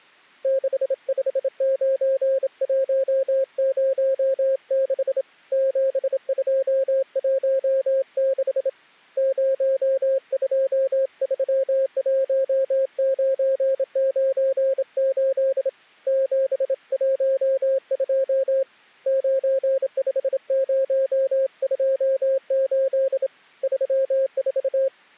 Morse code, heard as a keyed tone, hand-sent with a straight key, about 27 wpm, 540 Hz. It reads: 659106 7216 0231998 712 95028 34